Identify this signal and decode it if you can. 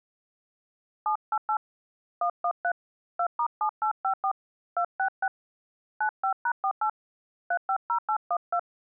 DTMF, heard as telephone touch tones, dialled by hand, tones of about 80 ms. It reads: 788 113 2*7854 266 95#48 350812